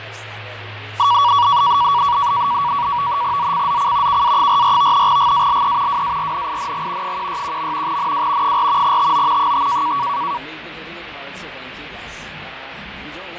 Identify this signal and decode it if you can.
NAVTEX (SITOR-B), 100 baud, 170 Hz shift, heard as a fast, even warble, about 1040 Hz centre, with radio static and fading. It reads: ZCZC KA44 GALE WARNING 161. NW 4 TO 5